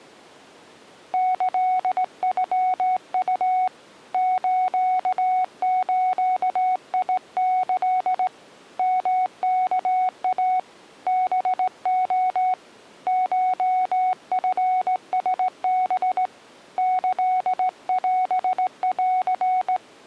Morse code (Japanese Wabun code), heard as a keyed tone, hand-sent with a straight key, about 18 wpm, 740 Hz. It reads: キノウ スズキ ヨワイ ハレ コチラハ キオン